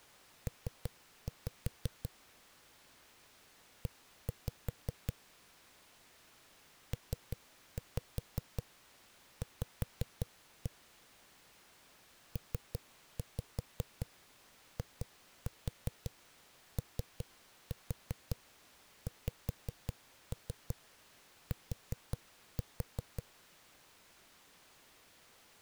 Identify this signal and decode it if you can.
Tap code, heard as knocks on a wall, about 5 knocks a second. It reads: P E PV PIOXT